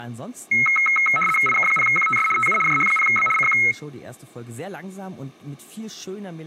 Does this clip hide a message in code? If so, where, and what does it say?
Yes: RTTY (75 baud, 850 Hz shift) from 0.5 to 3.7 s, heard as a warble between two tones, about 1700 Hz centre, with speech in German. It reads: IK0QTS TU JH0B CQ